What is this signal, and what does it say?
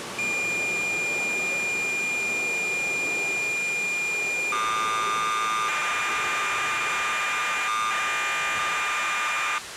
Cassette data (Kansas City type), 1200 baud, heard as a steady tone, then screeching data, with tape hiss and the noise of a subway station.